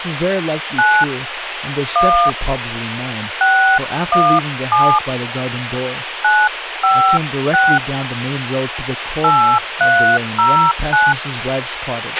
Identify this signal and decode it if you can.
DTMF, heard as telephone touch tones, dialled by hand, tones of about 290 ms, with radio hiss, a squelch burst at the end and speech in English. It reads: 9 1 617 956 8309